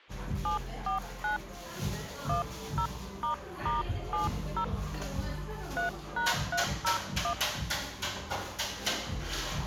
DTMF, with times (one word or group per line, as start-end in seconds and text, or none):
0.5-1.4 749
2.3-4.6 10**70
5.8-7.3 3#301